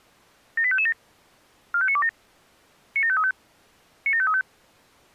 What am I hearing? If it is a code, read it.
Five-tone selective call (ZVEI), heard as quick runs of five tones, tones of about 70 ms. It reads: 78557 45927 97535 97535